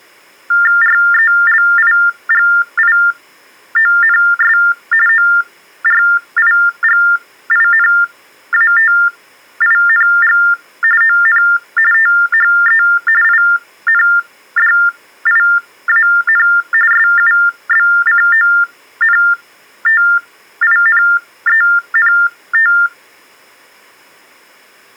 TTY/TDD text telephone tones (45.45 baud Baudot), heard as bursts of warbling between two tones, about 400 Hz shift, 1600 Hz centre. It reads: RELIGIONS ORIGINATING ON THE INDIAN SUBCONTINENT